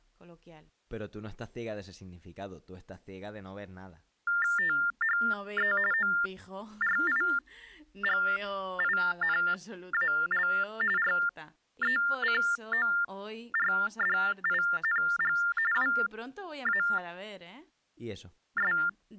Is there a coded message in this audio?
Yes: TTY/TDD text telephone tones (45.45 baud Baudot) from 4.3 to 18.9 s, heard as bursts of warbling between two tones, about 400 Hz shift, 1600 Hz centre, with speech in Spanish. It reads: THE ORIGINAL RECORDING WAS